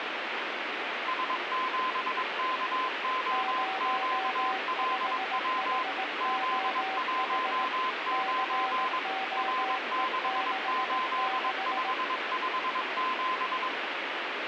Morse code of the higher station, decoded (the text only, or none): S7KOQLW Z19 R68557